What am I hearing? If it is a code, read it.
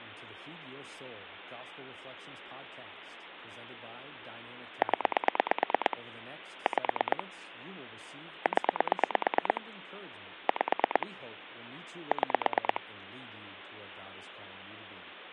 Pulse dialling, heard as clicks on a phone line, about 9 pulses a second, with phone line noise and speech in English. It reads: 0 5 0 5 6